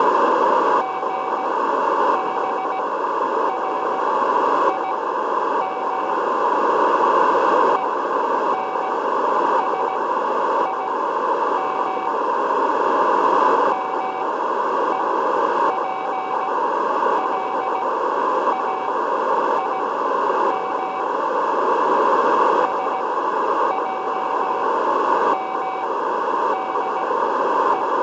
Morse code (Hebrew alphabet), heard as a keyed tone, machine-sent, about 17 wpm, spaced as for 9 wpm, 760 Hz, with radio static, a narrow filter and room echo. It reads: גברים ונשים מופלאים שעמדו